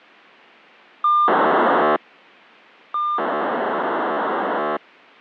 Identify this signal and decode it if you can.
POCSAG pager data (2400 baud), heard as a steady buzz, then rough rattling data, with a squelch burst at the end.